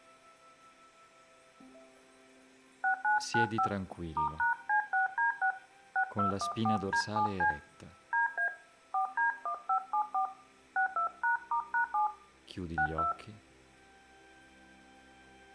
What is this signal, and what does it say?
DTMF, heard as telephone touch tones, dialled by hand, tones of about 110 ms, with room echo. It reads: 6995 *#C6D6 6214D7C DA 4D1574 62#*#7 62